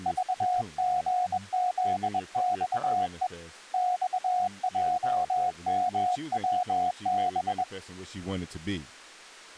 Morse code, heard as a keyed tone, hand-sent with a bug key, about 21 wpm, 730 Hz, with speech in English. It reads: VGZXE XJMWB